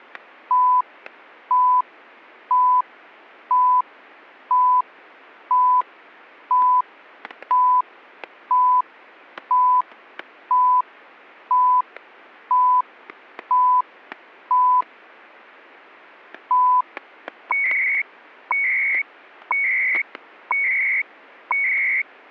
Radio time signal (CHU, Canada), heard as beeps and data bursts, one a second, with static crashes.